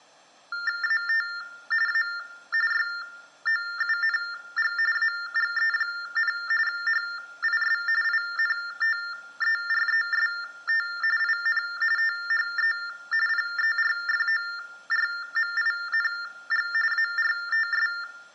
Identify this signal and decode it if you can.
TTY/TDD text telephone tones (45.45 baud Baudot), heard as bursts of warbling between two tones, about 400 Hz shift, 1600 Hz centre, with room echo. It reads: AT A YOUNG AGE, HIS INTEREST IN THE PERFORMING ARTS